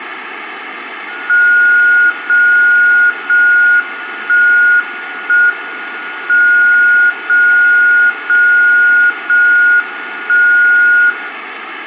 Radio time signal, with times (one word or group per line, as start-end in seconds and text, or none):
1.3-2.3 0
2.3-3.3 0
3.3-4.3 1
4.3-5.3 1
5.3-6.3 M
6.3-7.3 0
7.3-8.3 0
8.3-9.3 0
9.3-10.3 1
10.3-11.3 0